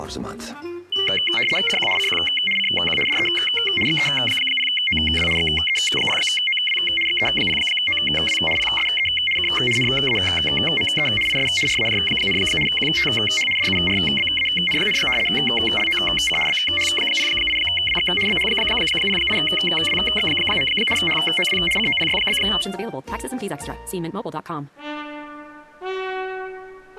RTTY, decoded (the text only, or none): CQ CQ CQ DE XE0OW XE0OW XE0OW PSE K NAME IS RAJ, QTH DURBAN, LOC BH08WX BH08WX. HOW COPY?